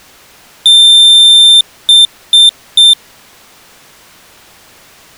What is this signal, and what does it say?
Beep code, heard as a piezo beeper, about 3600 Hz. 1 long, 3 short. In Award and IBM BIOS tables: video adapter failure; in AMI BIOS tables: memory failure.